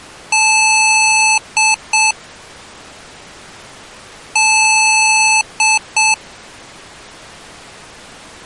Beep code, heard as beeps from a small speaker, played twice, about 870 Hz. 1 long, 2 short. In Award, IBM and AMI BIOS tables: video adapter failure.